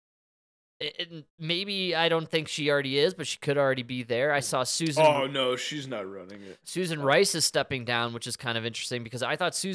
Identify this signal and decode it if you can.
Speech in English. There is no code.